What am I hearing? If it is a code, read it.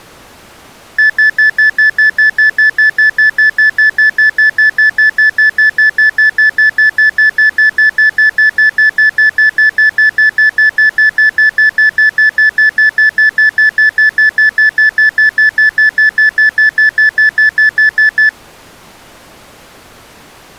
Evenly repeated beeps. There is no code.